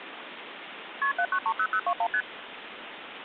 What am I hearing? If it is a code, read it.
Multi-frequency trunk signalling (R1, as on North American trunks), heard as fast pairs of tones, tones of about 70 ms, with phone line noise. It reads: KP 7930021 ST